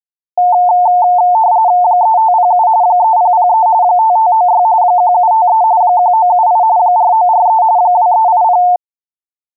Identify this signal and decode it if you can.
RTTY (45.45 baud, 170 Hz shift), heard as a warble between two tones, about 800 Hz centre. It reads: 3507 3003 5596 1753 1978 4943 2380